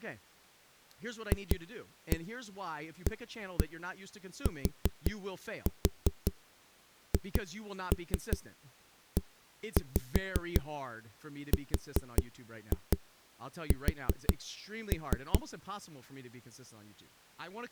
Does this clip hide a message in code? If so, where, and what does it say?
Yes: tap code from 1.3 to 15.4 s, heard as knocks on a wall, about 5 knocks a second, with speech in English. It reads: FATHERS